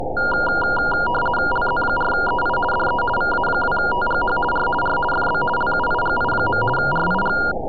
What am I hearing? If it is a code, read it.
RTTY (50 baud, 450 Hz shift), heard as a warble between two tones, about 1190 Hz centre. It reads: LZ4EI DE VA2TGH R R FB LUIGI. RIG